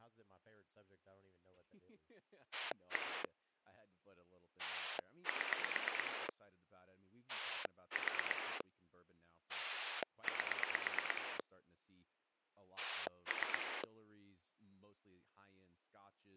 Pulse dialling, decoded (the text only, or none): 1 7 4 8 3